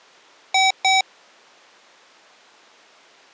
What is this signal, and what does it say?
Beep code, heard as beeps from a small speaker, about 760 Hz. 2 short. In AMI BIOS tables: memory parity error; in IBM BIOS tables: self-test error shown on screen; in Dell tables: no memory detected.